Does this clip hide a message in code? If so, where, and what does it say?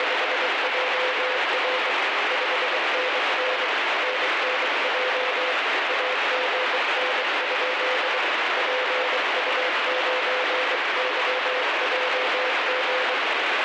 Yes: Morse code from 0.0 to 13.2 s, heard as a keyed tone, hand-sent with a bug key, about 23 wpm, 510 Hz, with heavy radio static. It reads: … 5NN NNJ AGN? PU9YJG